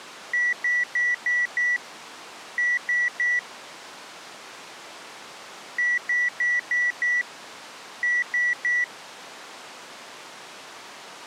Beep code, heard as beeps, played twice, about 1950 Hz. 5-3.